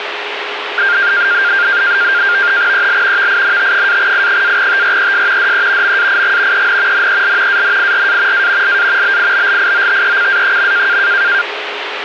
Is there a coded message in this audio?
Yes: NAVTEX (SITOR-B), 100 baud, 170 Hz shift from 0.8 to 11.4 s, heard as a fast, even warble, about 1500 Hz centre, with radio static. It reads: EL VINT-I-TRES DE MAIG EN NEL ANIRA A LA BIBLIOTECA.